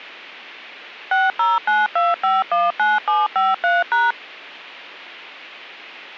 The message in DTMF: 6092519753#

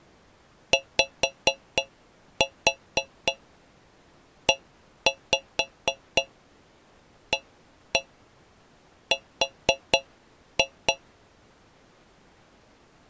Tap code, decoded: YEAR

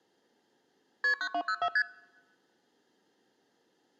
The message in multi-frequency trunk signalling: KP 9204 ST

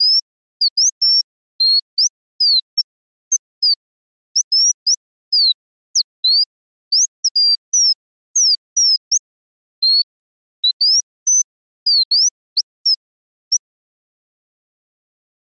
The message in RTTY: none

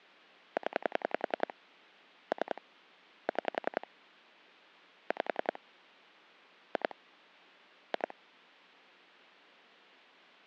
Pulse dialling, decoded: 0 3 6 5 2 2

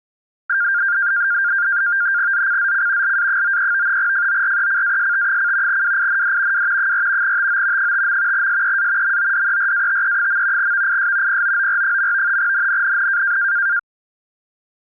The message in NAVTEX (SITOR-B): ZCZC LA93 FORECAST: WIND W 4 TO 5. SEA MODERATE. VIS POOR. NNNN

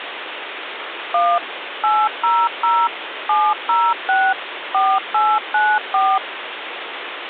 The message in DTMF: 1 800 706 4894

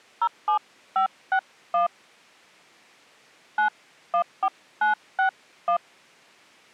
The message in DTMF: 07561 914961

